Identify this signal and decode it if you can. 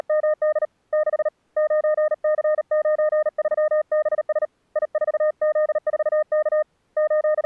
Morse code, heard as a keyed tone, hand-sent with a paddle, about 38 wpm, 610 Hz. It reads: … 6 9C93BS I4Z4K …